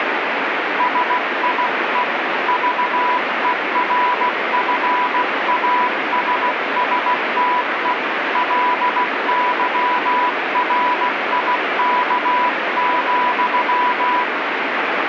Morse code, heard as a keyed tone, hand-sent with a paddle, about 16 wpm, 990 Hz, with heavy radio static. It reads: SIE VERFASSTE LYRIK,